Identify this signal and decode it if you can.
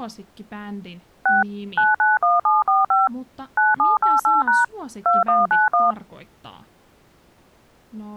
DTMF, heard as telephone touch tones, dialled by machine, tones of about 170 ms, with speech in Finnish. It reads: 6 991745 9788# 2191